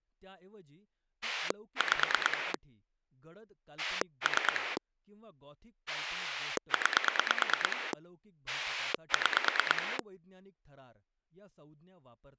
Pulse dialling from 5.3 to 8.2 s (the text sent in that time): 9